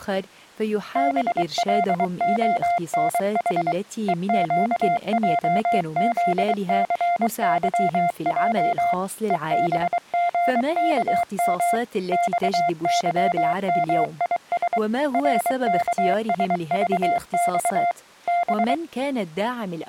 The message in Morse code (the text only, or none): BLONH EQJZCYJ EBGKM XYMIS RKSVX B